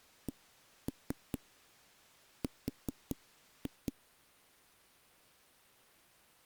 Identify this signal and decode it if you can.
Tap code, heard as knocks on a wall, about 5 knocks a second. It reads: CR